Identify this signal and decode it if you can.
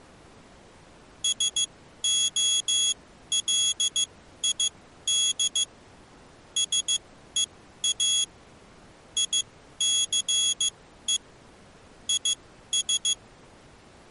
Morse code, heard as a high beeper, machine-sent, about 15 wpm, spaced as for 12 wpm, 3350 Hz. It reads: SOLID SEA ICE IS